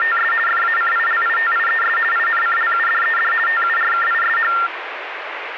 RTTY (50 baud, 450 Hz shift), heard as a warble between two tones, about 1600 Hz centre, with radio static. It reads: … FACILITIES INCLUDED TURKISH